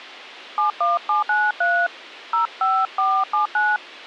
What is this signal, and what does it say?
DTMF, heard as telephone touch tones, dialled by hand, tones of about 210 ms. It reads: 71793 05479